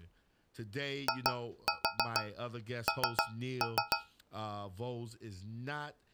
Tap code, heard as taps on a metal pipe, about 6 knocks a second, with speech in English. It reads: IN